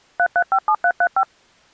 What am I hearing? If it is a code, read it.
DTMF, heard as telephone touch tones, dialled by machine, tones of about 70 ms. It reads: 3357335